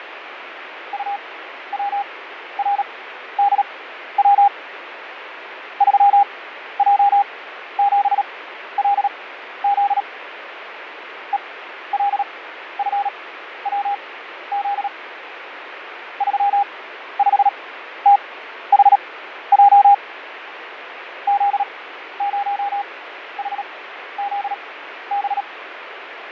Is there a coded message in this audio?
Yes: Morse code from 0.9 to 25.5 s, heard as a keyed tone, machine-sent, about 37 wpm, spaced as for 13 wpm, 810 Hz, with radio static and fading. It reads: UWRDW 3J7LZ ELFWZ 35THJ Z0HZB